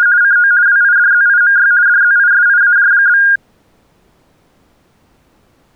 RTTY (50 baud, 170 Hz shift), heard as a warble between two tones, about 1550 Hz centre. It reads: … CO WIDZIMY DZISIAJ?